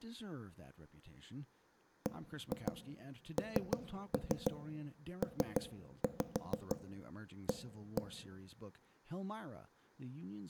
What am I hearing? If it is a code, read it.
Tap code, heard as knocks on wood, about 6 knocks a second, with speech in English. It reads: BNPA